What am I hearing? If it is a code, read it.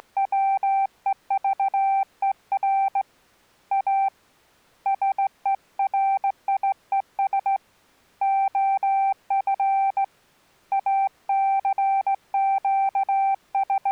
Morse code, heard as a keyed tone, hand-sent with a straight key, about 17 wpm, 780 Hz. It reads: … A SERIES OF …